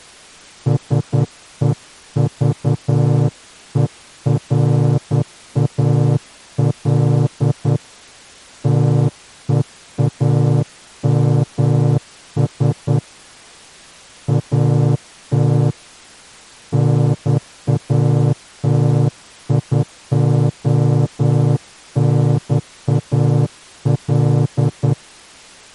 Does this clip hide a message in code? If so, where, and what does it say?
Yes: Morse code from 0.6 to 25.0 s, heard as a horn, hand-sent with a straight key, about 10 wpm. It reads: SEVERAL TEAMS AT NATIONAL